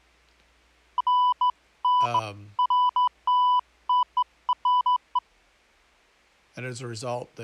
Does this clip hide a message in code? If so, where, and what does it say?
No, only beeps of irregular length.